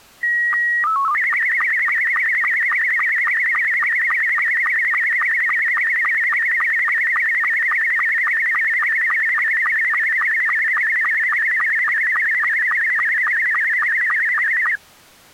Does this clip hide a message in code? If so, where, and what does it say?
Yes: SSTV (slow-scan television), Scottie S2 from 0.2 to 14.8 s, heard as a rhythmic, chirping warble.